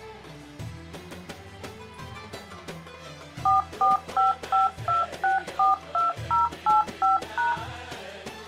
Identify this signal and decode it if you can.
DTMF, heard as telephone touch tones, dialled by machine, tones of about 150 ms. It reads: 44552642085#